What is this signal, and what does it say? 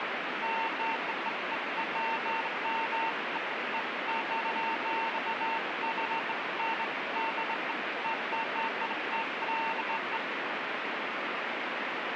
Beeps of irregular length, with radio static. There is no code.